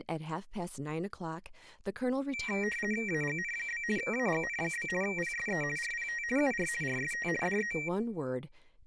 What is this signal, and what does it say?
RTTY (50 baud, 450 Hz shift), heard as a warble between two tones, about 2100 Hz centre, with speech in English. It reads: AGN? AGN? PSE RPT UR RST DE